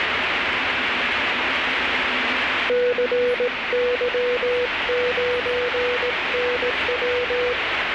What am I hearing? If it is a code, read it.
Morse code, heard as a keyed tone, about 18 wpm, 490 Hz, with radio static and the noise inside a subway train. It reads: CY9NW